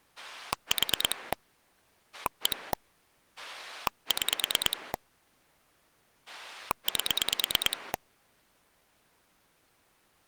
Pulse dialling, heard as a rotary dial, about 9 pulses a second. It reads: 4 1 6 8